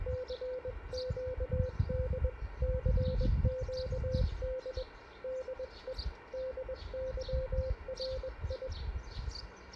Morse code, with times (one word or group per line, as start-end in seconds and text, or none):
0.1-2.3 CQD
2.6-4.8 CQD
5.2-5.9 DE
6.3-8.7 DYRI